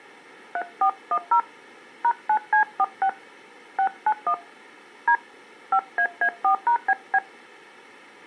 DTMF, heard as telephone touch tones, dialled by hand, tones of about 80 ms. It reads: 3410 #9C46 691 D 5AA4#BB